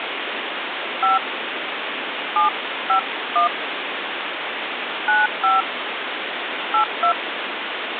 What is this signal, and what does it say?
DTMF, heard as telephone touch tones, dialled by hand, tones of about 140 ms, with phone line noise. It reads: 5 751 95 82